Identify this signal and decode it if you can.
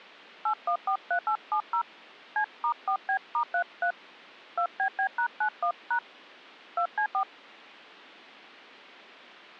DTMF, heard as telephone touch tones, dialled by hand, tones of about 80 ms. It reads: 8143870 C*4B*33 2BB#91# 2C4